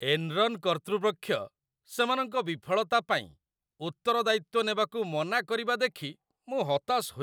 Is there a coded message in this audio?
No, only speech in Odia.